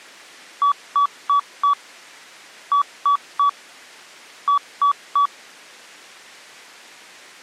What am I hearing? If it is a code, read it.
Beep code, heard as beeps, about 1140 Hz. 4-3-3. In Phoenix BIOS tables: timer channel 2 failure.